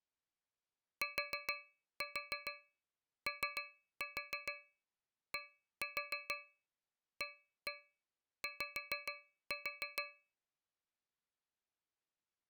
Tap code, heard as taps on a metal pipe, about 6 knocks a second. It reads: TODAY